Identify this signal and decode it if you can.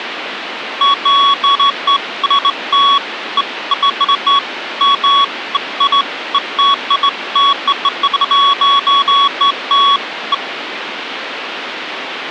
Beeps of irregular length, with phone line noise. There is no code.